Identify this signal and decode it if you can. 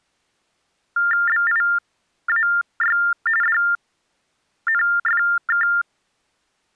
TTY/TDD text telephone tones (45.45 baud Baudot), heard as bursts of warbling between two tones, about 400 Hz shift, 1600 Hz centre. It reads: BIAY DNFK